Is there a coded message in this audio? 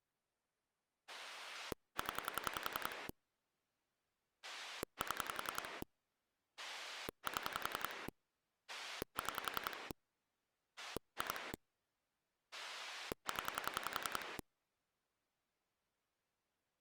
Yes: pulse dialling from 1.1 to 14.4 s, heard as a rotary dial, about 10 pulses a second. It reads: 0 7 7 6 2 0